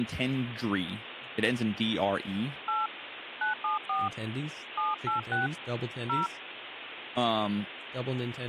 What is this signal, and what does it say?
DTMF, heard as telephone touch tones, dialled by hand, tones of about 170 ms, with phone line noise and speech in English. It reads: 8 974 786 0